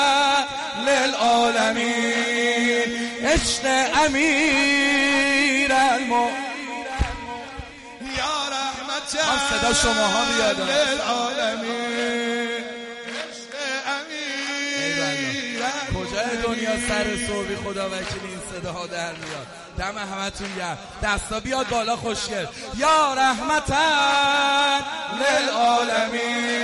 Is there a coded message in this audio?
No.